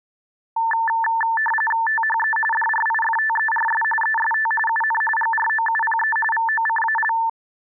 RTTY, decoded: THE DRIFTERS EST UN GROUPE VOCAL

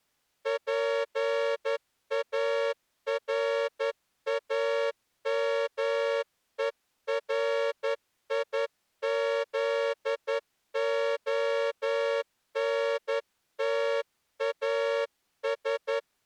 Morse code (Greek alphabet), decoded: ΠΑΡΑΜΕΡΙΖΟΝΤΑΣ

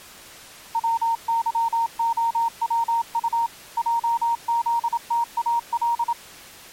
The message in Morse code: WYOWU JZTAL

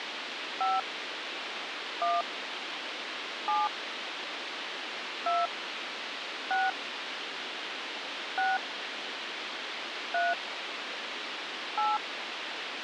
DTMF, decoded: 5 1 7 2 6 6 3 8

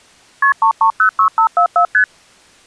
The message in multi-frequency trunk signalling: KP 3306544 ST

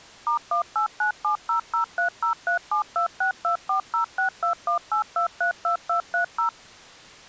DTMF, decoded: *1897003037262406218232230

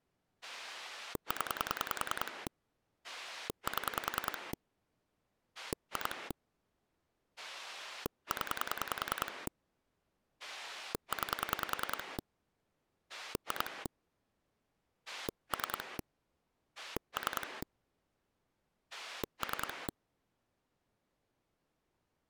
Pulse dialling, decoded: 0 7 2 0 9 2 3 3 3

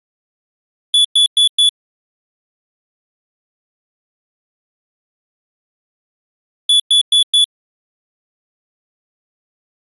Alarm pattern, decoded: temporal four

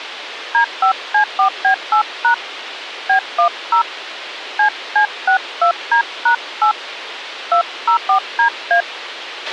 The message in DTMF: D5C4B8# B10 CC62D#8 204DA

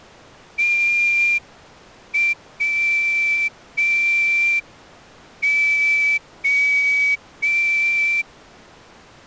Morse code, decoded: TWO

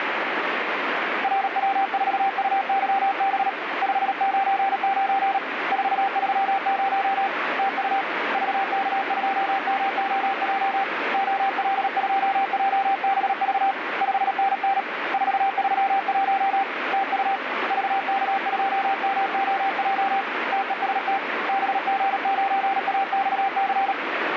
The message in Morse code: RW4UYB 599 430 TU VK2MOJ OL2JBV 5NN 431 TU VK2MOJ TEST BG9AXC

